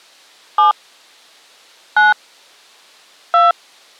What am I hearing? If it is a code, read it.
DTMF, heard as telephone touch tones, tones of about 130 ms. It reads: 7 9 2